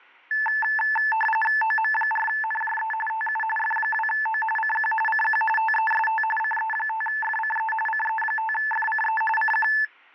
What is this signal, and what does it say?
RTTY (45.45 baud, 850 Hz shift), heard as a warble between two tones, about 1310 Hz centre. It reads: OM4NJE TU F2O CQ CQ TEST CE5FCE CE5FCE CQ